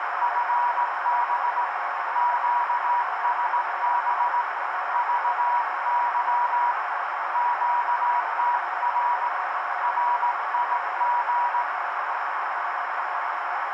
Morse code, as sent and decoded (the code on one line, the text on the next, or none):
..-. -... / --.- ... -... / ...- -.-- / --.- - .-. / .-. .. --.
FB QSB VY QTR RIG